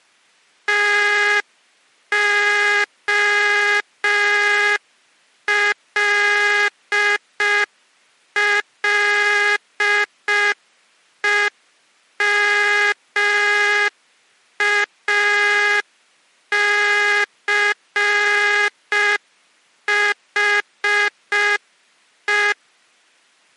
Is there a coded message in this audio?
Yes: Morse code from 0.6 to 22.6 s, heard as a buzzer, machine-sent, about 5 wpm. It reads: TOLLEMACHE